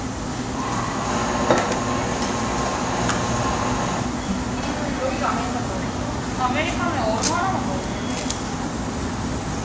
The noise of a crowd indoors. There is no code.